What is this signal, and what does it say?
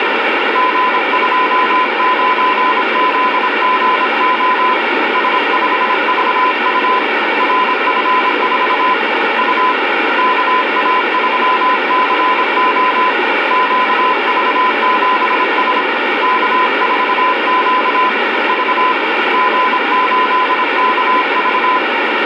Morse code, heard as a keyed tone, hand-sent with a paddle, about 26 wpm, 1010 Hz, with radio static. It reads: G29ZGO S5VU RF4 U KA3CO QV7S K4Q V G8KV